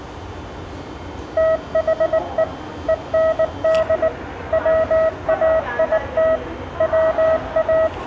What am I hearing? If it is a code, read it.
Morse code, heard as a keyed tone, machine-sent, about 19 wpm, 640 Hz, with the noise of a subway station. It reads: THE END WAIT …